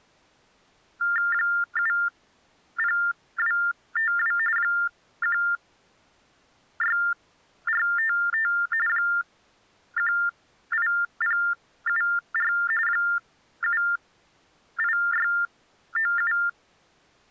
TTY/TDD text telephone tones (45.45 baud Baudot), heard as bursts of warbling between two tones, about 400 Hz shift, 1600 Hz centre. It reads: 70252 16455 18074 78697